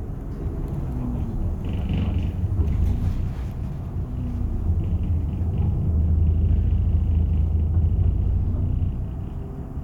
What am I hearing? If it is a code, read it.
The noise inside a bus. There is no code.